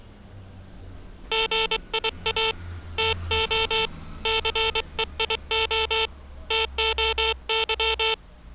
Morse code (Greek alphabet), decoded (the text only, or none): ΓΙΑ ΤΟ ΘΕΙΟ ΤΟΥ